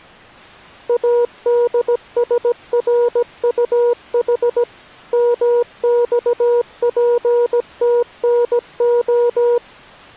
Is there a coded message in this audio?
Yes: Morse code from 0.8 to 9.6 s, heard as a keyed tone, machine-sent, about 17 wpm, 480 Hz. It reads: ADSRUH MXPTNO